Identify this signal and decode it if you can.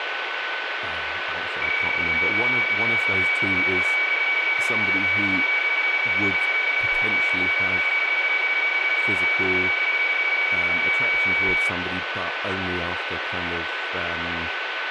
PSK31 (31.25 baud), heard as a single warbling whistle, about 2250 Hz, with radio static, a steady whistle near 1510 Hz and speech in English.